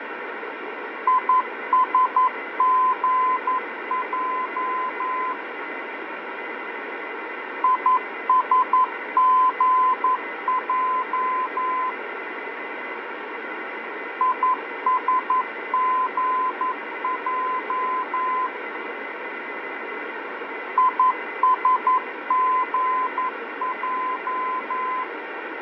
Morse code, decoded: ISGJ ISGJ ISGJ ISGJ

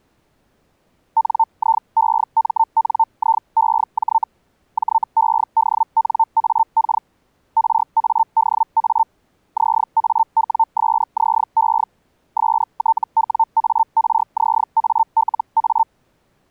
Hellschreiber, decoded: NIEMNIEJ JEDNAK RADA ZAWSZE STWARZALA

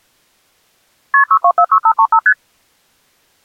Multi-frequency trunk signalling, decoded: KP 6246535 ST

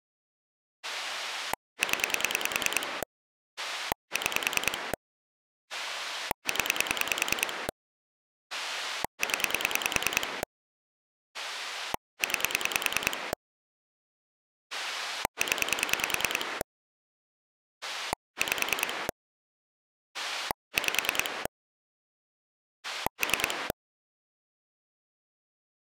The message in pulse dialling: 0 6 0 0 9 0 5 5 3

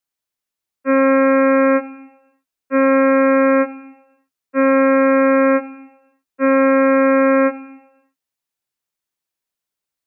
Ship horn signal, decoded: 4 short

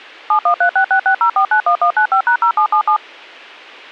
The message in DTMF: 7136660491195#0777

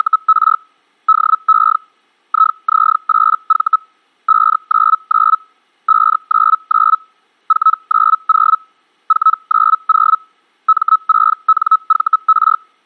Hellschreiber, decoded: … DE IZ8V 599 599 490 490 M6NVR

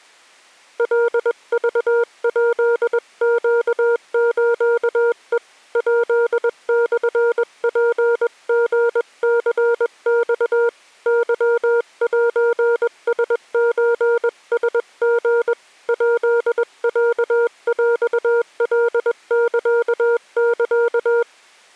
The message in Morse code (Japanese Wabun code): カクヱネスヘ ヱモツリニマ ケセラソラリ ヱロヰカササ

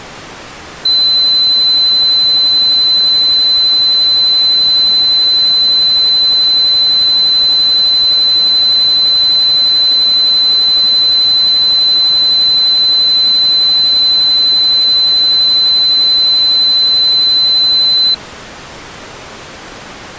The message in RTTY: none

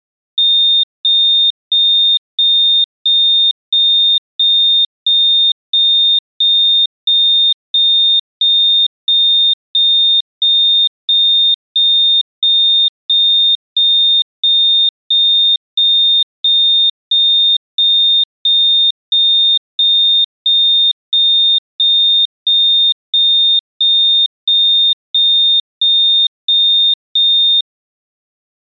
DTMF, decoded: none

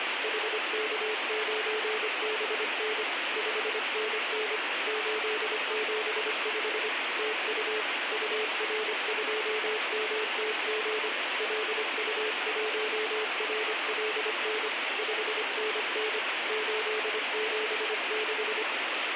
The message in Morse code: HK9BN 5NN 875 TU UR2MTG LU1RLN 5NN 876

